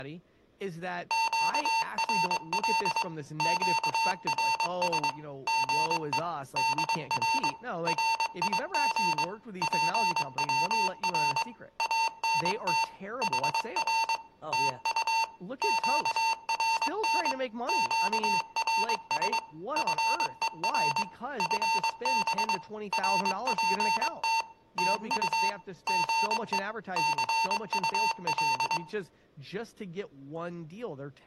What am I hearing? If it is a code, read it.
Morse code, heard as electronic beeps, machine-sent, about 22 wpm, 900 Hz, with room echo and speech in English. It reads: QRL QRS GE DR RIG PWR ANT HR TU QRN QRS FER FB RPT TU GE CUL